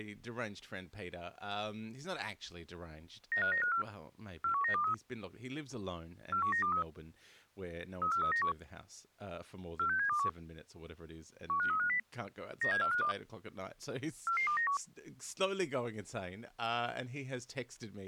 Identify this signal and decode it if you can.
Five-tone selective call (CCIR), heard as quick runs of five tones, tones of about 100 ms, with speech in English. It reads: 95954 41923 41923 34391 46721 15350 97452 44291